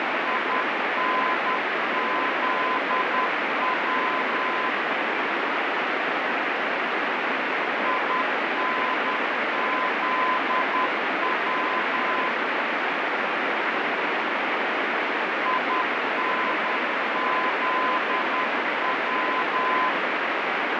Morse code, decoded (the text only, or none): INZW INZW INZW